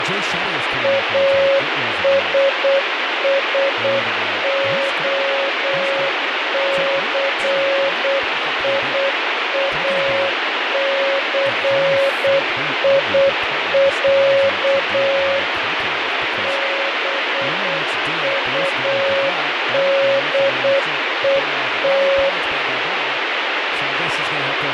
Morse code (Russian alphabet), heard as a keyed tone, machine-sent, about 8 wpm, 550 Hz, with heavy radio static, fading and speech in English. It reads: АССОЦИАЦИЯ БУДЕТ